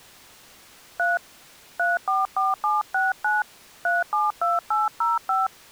DTMF, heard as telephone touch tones, dialled by hand, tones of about 180 ms. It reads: 3 344769 372805